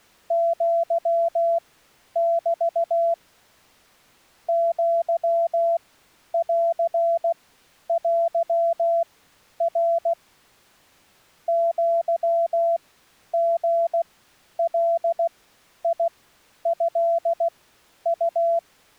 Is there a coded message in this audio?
Yes: Morse code (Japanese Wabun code) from 0.2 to 18.6 s, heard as a keyed tone, machine-sent, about 16 wpm, spaced as for 10 wpm, 670 Hz. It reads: アメ アンテナ アリガトウ